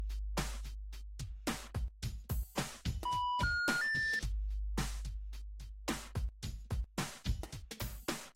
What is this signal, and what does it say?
Telephone call progress tone (North American plan), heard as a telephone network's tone, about 980, 1430, 1800 Hz. Special information tone.